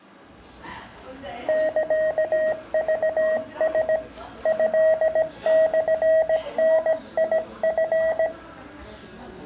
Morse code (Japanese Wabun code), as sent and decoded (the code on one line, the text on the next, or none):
-.-.- ...- ... / ..-.. -..-. -. .. ..-.
サクラ トモダチ